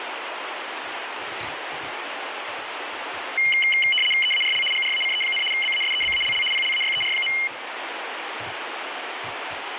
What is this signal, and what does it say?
RTTY (75 baud, 850 Hz shift), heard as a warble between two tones, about 2550 Hz centre, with radio static and kitchen noise. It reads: EARL GRACE, BASEBALL PLAYER.